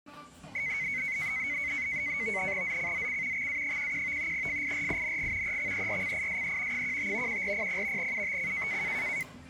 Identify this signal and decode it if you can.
NAVTEX (SITOR-B), 100 baud, 170 Hz shift, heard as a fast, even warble, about 2150 Hz centre, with the noise of a restaurant. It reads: ZCZC XA11 FIRING EXERCISE 15 1400 UTC